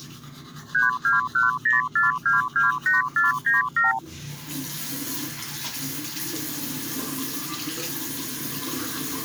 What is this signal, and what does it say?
Multi-frequency trunk signalling (R2, with the far end's replies), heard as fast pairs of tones, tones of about 150 ms, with the noise of a restroom. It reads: 32104228497